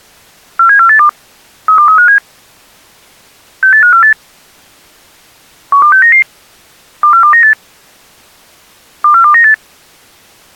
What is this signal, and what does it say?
Five-tone selective call (CCIR), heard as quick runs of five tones, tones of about 100 ms. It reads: 47482 32357 68548 12699 24298 24298